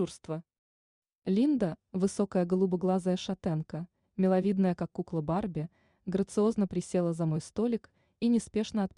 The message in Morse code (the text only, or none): none